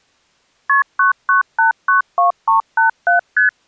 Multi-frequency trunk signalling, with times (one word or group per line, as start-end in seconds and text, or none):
0.7-0.8 KP
1.0-3.2 99892387
3.4-3.5 ST